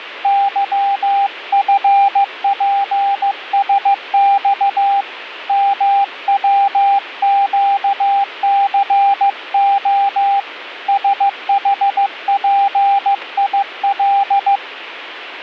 Morse code, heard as a keyed tone, hand-sent with a paddle, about 15 wpm, 800 Hz. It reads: YFPSX MWQCO SHPIL